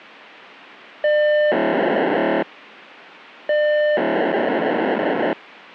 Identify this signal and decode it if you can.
POCSAG pager data (1200 baud), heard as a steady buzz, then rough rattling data.